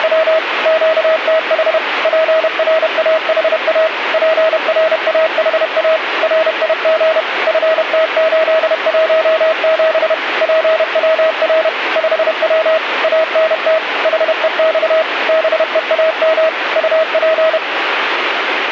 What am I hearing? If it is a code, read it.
Morse code, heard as a keyed tone, machine-sent, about 31 wpm, 640 Hz, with radio static. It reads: … QTH PRAHA PRAHA RIG FT817 PWR 5W ANT HEX BEAM UP